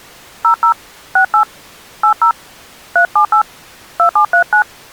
DTMF, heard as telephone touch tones, dialled by hand, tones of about 100 ms. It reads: 00 68 80 378 2739